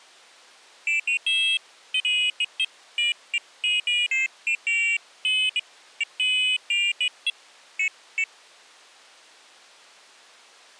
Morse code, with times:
none

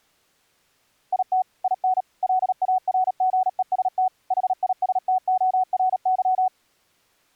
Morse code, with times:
1.1-1.4 IT
1.6-2.0 IN
2.2-4.1 LARGEST
4.3-6.5 HISTORY

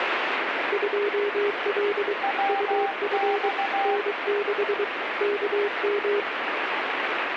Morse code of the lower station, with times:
0.7-2.1 2L
2.5-3.5 UF
3.9-4.8 N6
5.2-6.2 KM

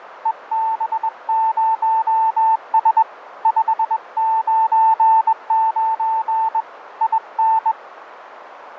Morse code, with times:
0.3-3.0 EB0S
3.5-6.6 599
7.0-7.7 IN

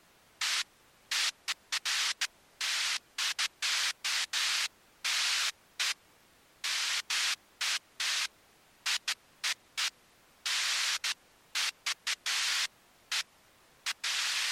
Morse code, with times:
none

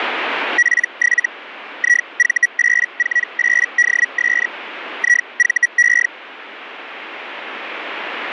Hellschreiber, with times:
0.6-1.3 P7
1.8-4.5 IV848DS
5.0-6.1 IVE

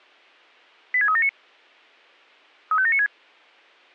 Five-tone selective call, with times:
0.9-1.3 86379
2.7-3.1 35796

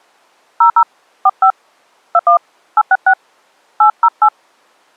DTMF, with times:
0.6-0.8 00
1.3-1.5 45
2.1-2.4 21
2.8-3.1 866
3.8-4.3 808

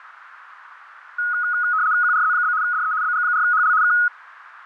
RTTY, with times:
2.0-2.5 QRZ?
2.6-2.9 DE
3.0-3.7 BG4HL
3.8-3.9 K

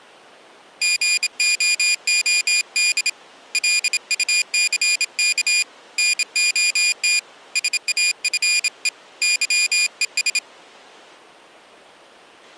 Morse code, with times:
0.8-3.1 GOOD
3.5-5.6 LUCK
6.0-7.2 NOT
7.6-8.9 SAFE
9.2-10.4 YES

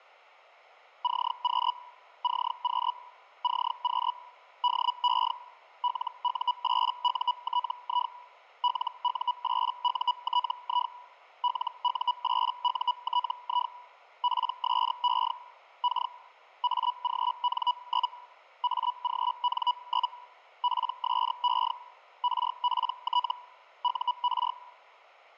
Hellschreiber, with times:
1.0-1.7 CQ
2.2-2.9 CQ
3.4-4.1 CQ
4.6-5.3 DE
5.8-8.1 LU8UTI
8.6-10.9 LU8UTI
11.4-13.7 LU8UTI
14.2-15.3 PSE
15.8-16.1 K
16.6-18.1 AGN?
18.6-20.1 AGN?
20.6-21.7 PSE
22.2-23.3 RPT
23.8-24.5 UR

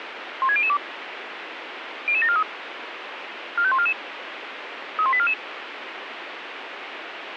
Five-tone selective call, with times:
0.4-0.8 16002
2.1-2.4 00743
3.6-3.9 45144
5.0-5.3 31844

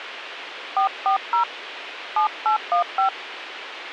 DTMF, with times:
0.8-1.4 440
2.2-3.1 7815

